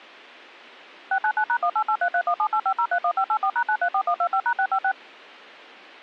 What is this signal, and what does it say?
DTMF, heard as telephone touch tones, dialled by machine, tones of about 70 ms. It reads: 699#188331785031584#934125#656